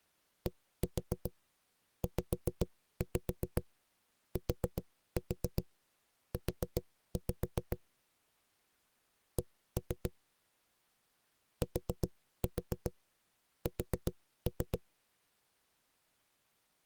Tap code, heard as knocks on a wall, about 7 knocks a second. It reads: DZTU C TS